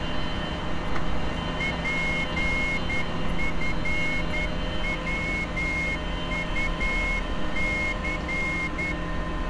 Morse code, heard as a whistle, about 10 wpm, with street noise. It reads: PFWUC